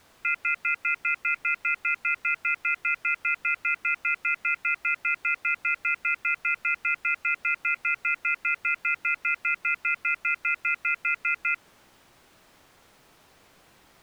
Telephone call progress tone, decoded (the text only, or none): off-hook warning tone